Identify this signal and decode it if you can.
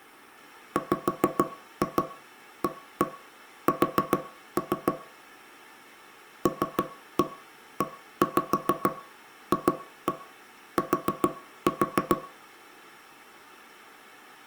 Tap code, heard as knocks on wood, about 6 knocks a second, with room echo. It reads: WAS LEFT